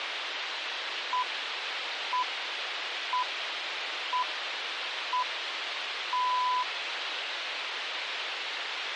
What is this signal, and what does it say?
Radio time signal (six pips, as the Greenwich Time Signal), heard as pips, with radio hiss.